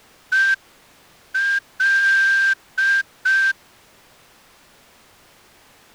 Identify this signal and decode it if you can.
Morse code, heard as a whistle, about 5 wpm. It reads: EL